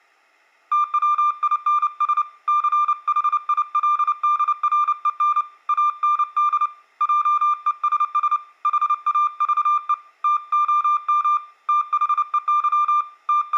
Morse code, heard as a keyed tone, hand-sent with a paddle, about 29 wpm, 1190 Hz, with room echo. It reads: TWINS CHILDREN AND JESS HAVE TOM THEY …